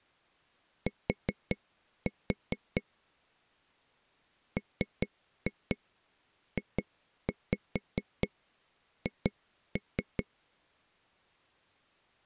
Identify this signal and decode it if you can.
Tap code, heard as taps on a table, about 4 knocks a second. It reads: T MJH